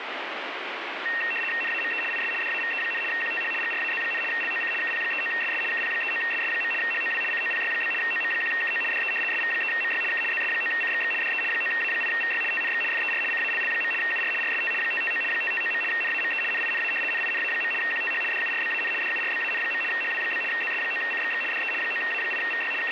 RTTY (75 baud, 850 Hz shift), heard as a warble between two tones, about 2300 Hz centre, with radio static. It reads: NAME IS DAVE, QTH GRAZ, LOC KP39SS KP39SS. HOW COPY? OM1KO DE SV3MY K ZS9CXX DE 9A8VY TNX FER CALL. UR RST 559 559. NAME NINA NINA. QTH DURBAN DURBAN. HW? ZS9CXX DE 9A8VY …